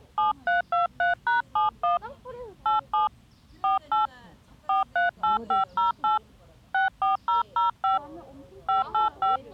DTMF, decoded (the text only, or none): 7323#71 87 48 438508 64005 585